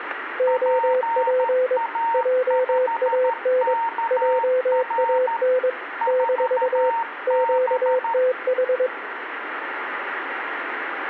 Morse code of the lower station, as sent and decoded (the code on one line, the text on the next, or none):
--- .--. / .--- .- -. / .--- .- -. / -....- / --.- - ....
OP JAN JAN - QTH